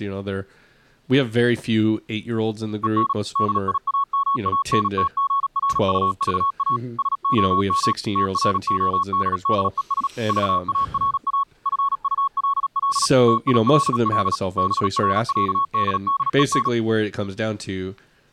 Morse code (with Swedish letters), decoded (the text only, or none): EN DIAMANTGRUVA SOM TRODDES VARA FULL TILL BRÄDDEN